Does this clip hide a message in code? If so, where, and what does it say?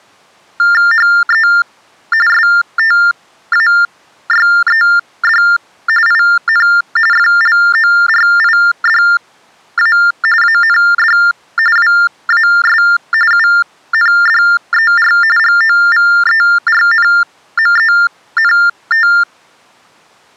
Yes: TTY/TDD text telephone tones (45.45 baud Baudot) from 0.6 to 19.2 s, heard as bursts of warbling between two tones, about 400 Hz shift, 1600 Hz centre. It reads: HE STAYED IN FLORIDA AND WAS UNDER GOVERNMENT